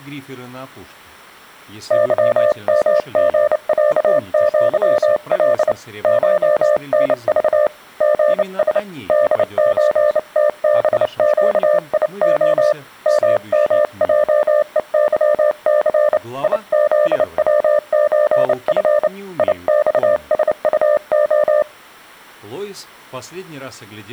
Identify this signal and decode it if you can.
Morse code (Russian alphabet), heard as a keyed tone, hand-sent with a bug key, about 29 wpm, 600 Hz. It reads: ЫМГЯЪЛ ШНЖ ГС ДЧТБЩИО ММЙЕЫЦ ИЗВЧФ ИЬСУО